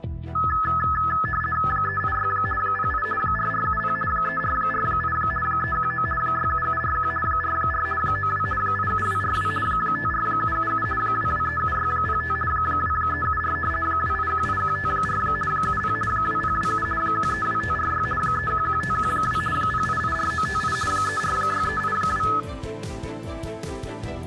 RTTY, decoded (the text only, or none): 386 08 4470 3448 319 67741 44 92 87242 54777 2237605 2374 2818154 70 2027 132546 311512 0884958 346382